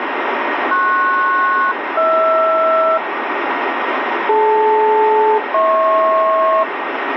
Aircraft SELCAL, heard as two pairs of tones, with radio static. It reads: PS-HR DL-HP